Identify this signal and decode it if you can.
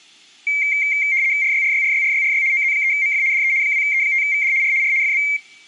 RTTY (75 baud, 170 Hz shift), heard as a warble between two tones, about 2200 Hz centre. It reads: RYRYRYRYRY OZ3MF DE 2E5VD R R FB